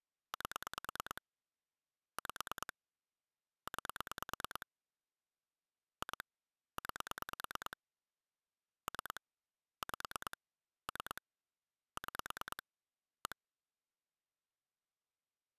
Pulse dialling, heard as clicks on a phone line, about 9 pulses a second. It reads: 8 5 9 2 9 3 5 3 6 1